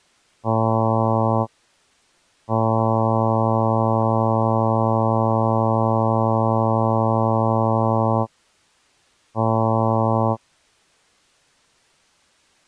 Ship horn signal, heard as a ship's horn, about 110 Hz. 1 short, 1 long, 1 short. At sea: a vessel at anchor warns of its position.